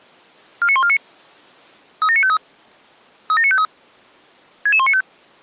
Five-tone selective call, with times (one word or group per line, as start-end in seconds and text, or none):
0.6-1.0 49149
2.0-2.4 37953
3.3-3.6 37953
4.7-5.0 66195